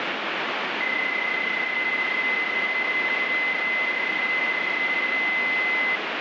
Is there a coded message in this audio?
Yes: PSK31 (31.25 baud) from 0.8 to 6.0 s, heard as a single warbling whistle, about 2050 Hz, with radio static.